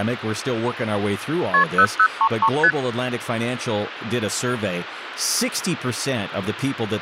Multi-frequency trunk signalling (R1, as on North American trunks), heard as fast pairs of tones, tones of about 70 ms, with phone line noise and speech in English. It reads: KP 0033 ST